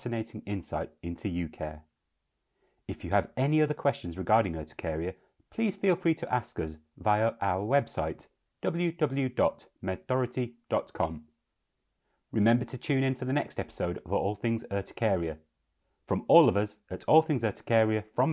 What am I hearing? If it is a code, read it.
Speech in English. There is no code.